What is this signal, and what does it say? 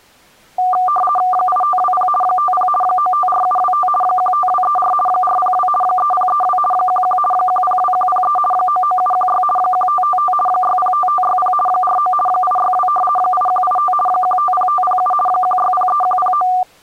RTTY (50 baud, 450 Hz shift), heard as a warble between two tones, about 960 Hz centre. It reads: 8520 50 954725 15234 402 3032 11 102103 99716 1555 605560 49 862 8185 150507 1603109